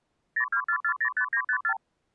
Multi-frequency trunk signalling (R2, with the far end's replies), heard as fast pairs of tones, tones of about 80 ms. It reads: 024405954